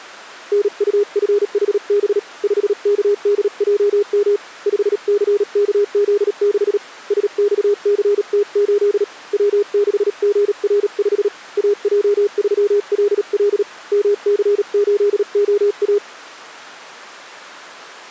Morse code, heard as a keyed tone, hand-sent with a paddle, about 37 wpm, 410 Hz. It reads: NUFHB 5KDJM 5CKZ6 SXCT8 W6GR5 AJ3LL MC8OA